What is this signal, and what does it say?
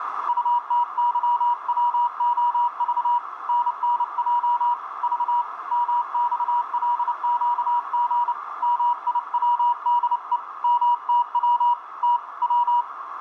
Morse code, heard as a keyed tone, hand-sent with a paddle, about 29 wpm, 960 Hz, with radio static and a narrow filter. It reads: UTYWOV NNJ V MXLQG MIWDE MTW T W